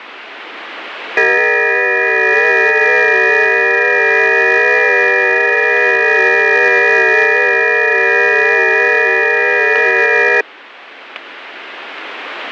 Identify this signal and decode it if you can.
FT8 (several signals at once), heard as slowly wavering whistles, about 6.25 baud, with radio static and static crashes.